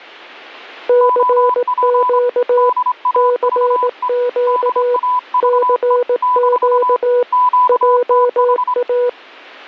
Morse code, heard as two keyed tones. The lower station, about 18 wpm, 490 Hz: CQ CQ CQ JA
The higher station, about 25 wpm, 1000 Hz: OP DAVE DAVE - QTH